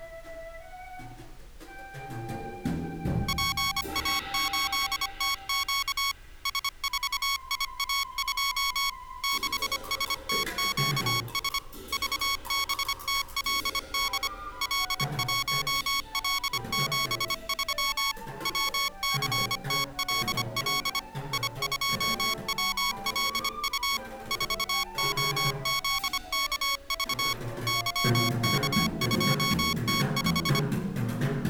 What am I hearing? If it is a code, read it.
Morse code, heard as electronic beeps, machine-sent, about 25 wpm, 1110 Hz. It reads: PA8TQ S4IA2 6STQS VBTLD L1L73 WCTLL I2WLU 4OZKV YK2T5